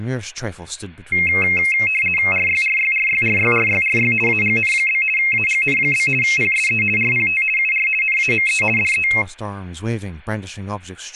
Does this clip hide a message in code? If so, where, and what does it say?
Yes: RTTY (50 baud, 450 Hz shift) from 1.1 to 9.2 s, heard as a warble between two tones, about 2350 Hz centre, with speech in English. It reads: RYRYRYRYRYRY AGN? AGN? PSE RPT UR NAME DE